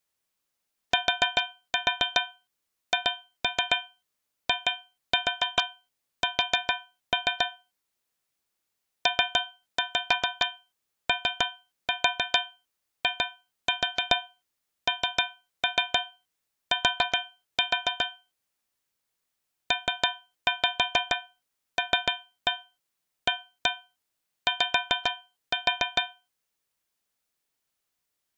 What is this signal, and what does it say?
Tap code, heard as taps on a metal pipe, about 7 knocks a second. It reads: THIS POINT PLAY